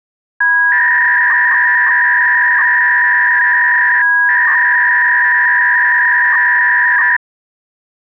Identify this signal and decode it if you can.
300-baud modem data (V.21 tones), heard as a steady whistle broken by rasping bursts, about 300 baud, 200 Hz shift.